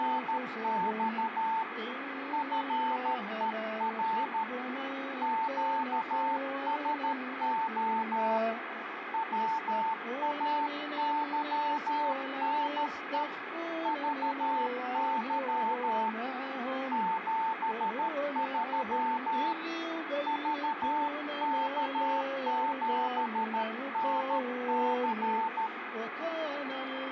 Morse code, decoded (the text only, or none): … FER QSO WAYNE VY 73 VK7NC